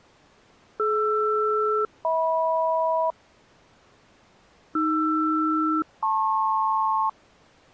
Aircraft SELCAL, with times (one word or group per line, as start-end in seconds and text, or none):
0.8-3.1 DR-HM
4.8-7.1 AR-LP